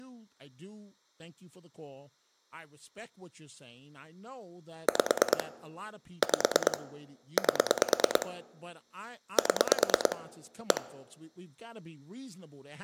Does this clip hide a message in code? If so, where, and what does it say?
Yes: pulse dialling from 4.9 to 10.8 s, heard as clicks on a phone line, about 9 pulses a second, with speech in English. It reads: 5 5 8 7 1